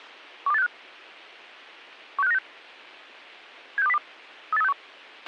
Five-tone selective call (EEA), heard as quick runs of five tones, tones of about 40 ms, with a squelch burst at the end. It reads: 12865 16596 76202 38361